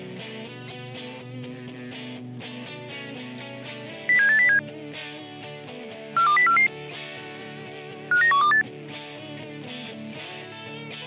Five-tone selective call (CCIR), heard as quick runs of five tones, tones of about 100 ms. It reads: 07807 42044 59128